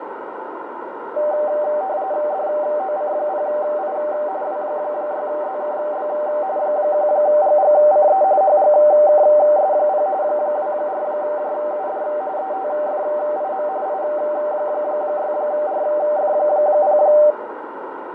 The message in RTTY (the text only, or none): DOC0I W6ZKB 1GGCE HGKS0 24JUD ETFIM I6RF0